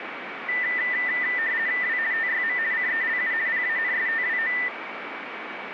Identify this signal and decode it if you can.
RTTY (50 baud, 170 Hz shift), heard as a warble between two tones, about 1900 Hz centre, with radio static and a steady whistle near 2280 Hz. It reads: W TYM CELU PANSTWO